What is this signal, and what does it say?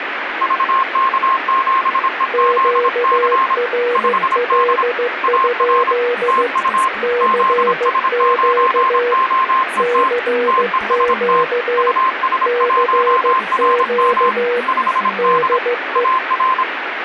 Morse code, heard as two keyed tones, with radio static. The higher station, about 26 wpm, 1050 Hz: VK7EZC 5D AR TU ZS9OET TEST US1RM 5D AR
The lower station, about 15 wpm, 480 Hz: QRL? CQ CQ CQ DE